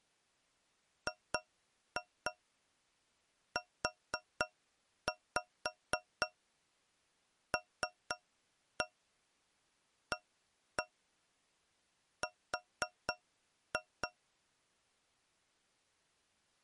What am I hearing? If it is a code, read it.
Tap code, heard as taps on a metal pipe, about 4 knocks a second. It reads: GULAR